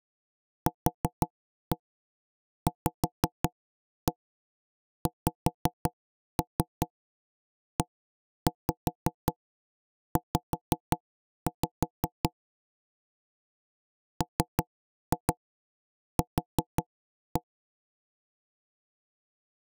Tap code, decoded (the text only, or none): QVXEZ MQ